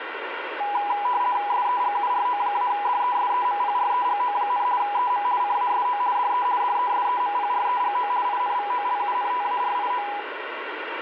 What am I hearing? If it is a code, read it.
RTTY (50 baud, 170 Hz shift), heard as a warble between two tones, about 900 Hz centre, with radio static. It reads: SEGURO-DESEMPREGO, EM CASO DE DESEMPREGO INVOLUNTARIO